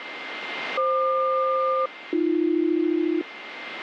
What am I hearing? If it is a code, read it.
Aircraft SELCAL, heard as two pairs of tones, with radio static and a steady whistle near 2090 Hz. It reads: FQ-AB